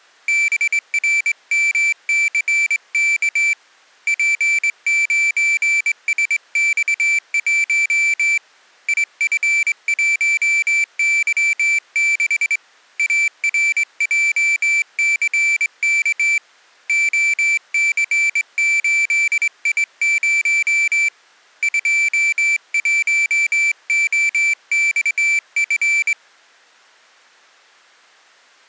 Morse code, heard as a high beeper, hand-sent with a straight key, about 22 wpm, 2350 Hz. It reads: BRMCK P9SX1 IF1Y6 ARJCK OC8I0 21OXF